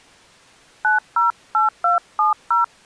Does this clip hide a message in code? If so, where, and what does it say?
Yes: DTMF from 0.8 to 2.6 s, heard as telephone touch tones, dialled by hand, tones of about 140 ms. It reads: 908270